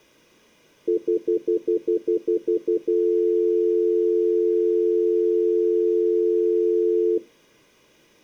Telephone call progress tone (North American plan), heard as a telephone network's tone, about 350, 440 Hz, 0.1 s on and 0.1 s off, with room echo. Stutter dial tone.